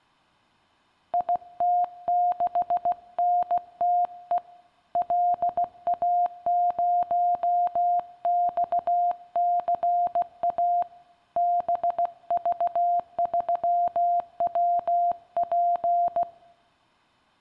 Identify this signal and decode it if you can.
Morse code, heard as a keyed tone, hand-sent with a paddle, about 16 wpm, 700 Hz. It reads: IT6NTE LA0XCA BV3WP